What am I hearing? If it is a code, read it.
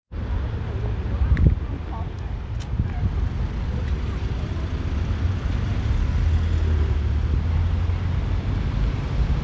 Street noise. There is no code.